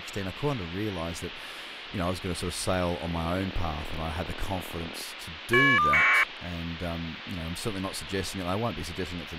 Caller ID data burst, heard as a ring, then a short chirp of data, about 1200 baud, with phone line noise and speech in English.